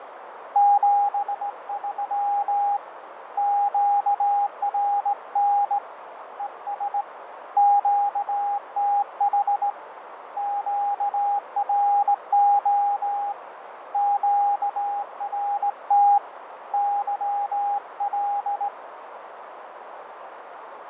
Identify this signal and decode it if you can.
Morse code, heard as a keyed tone, hand-sent with a straight key, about 18 wpm, 810 Hz, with radio static, fading and a narrow filter. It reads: 73 QRN ES QTH QRO QRT YL